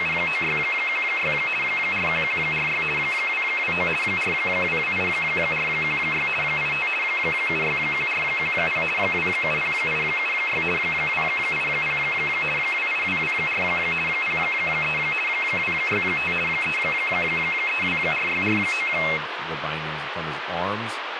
RTTY (50 baud, 450 Hz shift), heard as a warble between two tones, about 2350 Hz centre, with radio static and speech in English. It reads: … 41146 229 4228416 85 761410 270876 280 28224 03 265 3324649